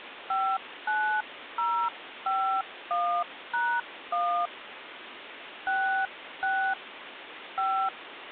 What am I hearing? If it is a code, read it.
DTMF, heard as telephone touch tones, dialled by hand, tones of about 300 ms, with phone line noise. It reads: 59051#1 66 5